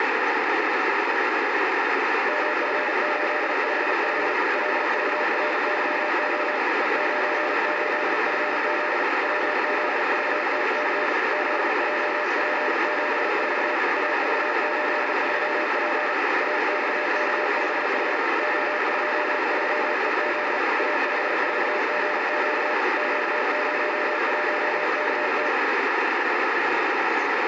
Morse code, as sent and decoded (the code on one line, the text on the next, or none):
-- ..-. ---.. ..... ..... / .-.. ...- .-. -.-- --- / . ----. ---.. ..-. --.. / .-- --.. ...- - -.-. / --.. .--- .--. --... ....- / .- ...- ---.. ...-- .--. / .- -..- -.- ..... .... / --- ..--- ...-- . --.. / .- ..... ....- --. --.- / --.- ----- .---- -.- -
MF855 LVRYO E98FZ WZVTC ZJP74 AV83P AXK5H O23EZ A54GQ Q01KT